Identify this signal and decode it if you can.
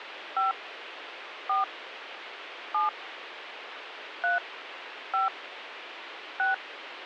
DTMF, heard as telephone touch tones, dialled by hand, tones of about 150 ms, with radio hiss. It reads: 5 4 7 3 5 6